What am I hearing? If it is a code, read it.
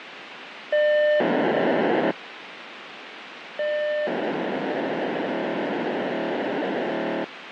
POCSAG pager data (1200 baud), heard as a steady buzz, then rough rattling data, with radio hiss and a squelch burst at the end.